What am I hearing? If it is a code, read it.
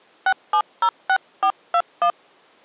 DTMF, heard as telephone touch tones, dialled by hand, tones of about 80 ms. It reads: 6706421